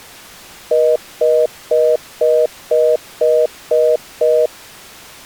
Telephone call progress tone (North American plan), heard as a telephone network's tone, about 480, 620 Hz, 0.25 s on and 0.25 s off. Congestion tone.